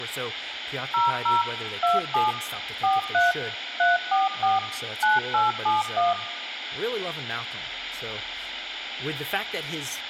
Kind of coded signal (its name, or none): DTMF